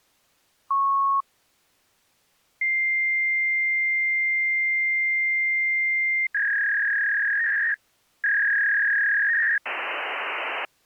Fax machine handshake, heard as a beep, a long tone, a warble and hiss.